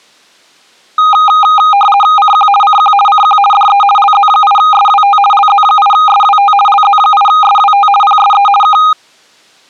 RTTY (50 baud, 450 Hz shift), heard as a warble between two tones, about 1030 Hz centre. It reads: CQ CQ CQ DE LZ8SWT LZ8SWT LZ8SWT PSE K